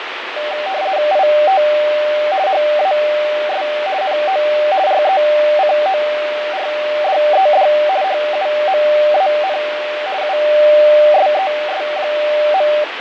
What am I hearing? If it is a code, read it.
RTTY (50 baud, 170 Hz shift), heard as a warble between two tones, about 680 Hz centre, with radio static and fading. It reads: IT HAS NO RECORDED HUMAN USES.